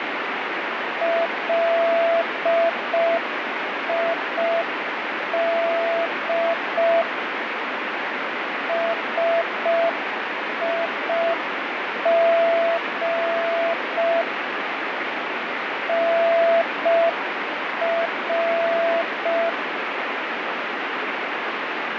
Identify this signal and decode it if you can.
Morse code, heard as a keyed tone, machine-sent, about 5 wpm, 670 Hz, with heavy radio static. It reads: LID SIG NR